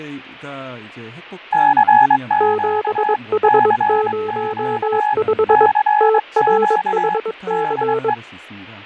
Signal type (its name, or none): Morse code